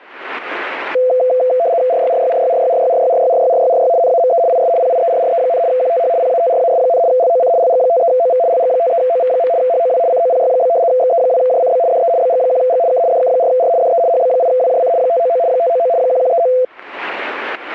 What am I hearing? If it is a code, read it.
RTTY (75 baud, 170 Hz shift), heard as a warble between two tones, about 590 Hz centre, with static crashes. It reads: RYRYRYRYRYRYRYRYRYRY NAME IS PIERRE, QTH PATRAS, LOC LG53OV LG53OV. HOW COPY? XE2JCB DE BG1G K DK4R DE HB8WJC 599 599 1139